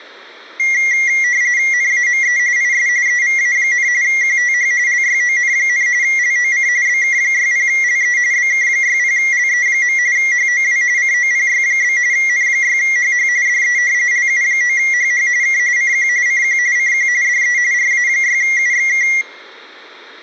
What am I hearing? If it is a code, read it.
RTTY (45.45 baud, 170 Hz shift), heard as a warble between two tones, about 2050 Hz centre. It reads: NAME IS EVA, QTH LYON, LOC BK60LE BK60LE. HOW COPY? N6HH DE LU9HH K CQ CQ CQ DE RA6UXK